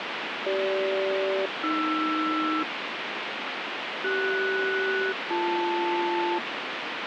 Aircraft SELCAL, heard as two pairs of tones, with radio static. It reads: CG-AR CS-BL